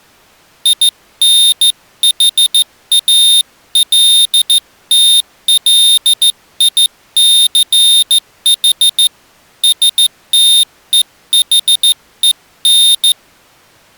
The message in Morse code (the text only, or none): INHALTLICH STEHEN